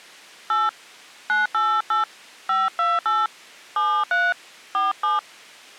DTMF, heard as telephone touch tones, dialled by hand, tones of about 210 ms. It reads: 8 988 528 73 47